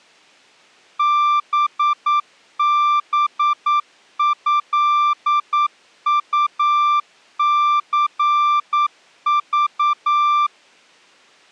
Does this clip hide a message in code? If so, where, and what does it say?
Yes: Morse code (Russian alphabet) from 0.9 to 10.5 s, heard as a keyed tone, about 9 wpm, 1180 Hz. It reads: ББЭУЦЖ